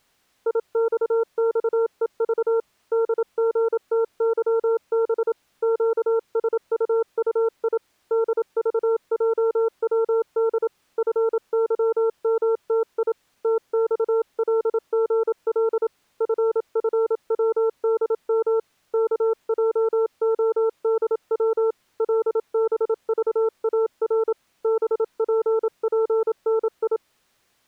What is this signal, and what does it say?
Morse code, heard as a keyed tone, hand-sent with a paddle, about 27 wpm, 450 Hz. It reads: IXXEV DGTYB QSUUI DVJWD FYMTI TXLGL FFWDM KJODW LBVAR BPPNI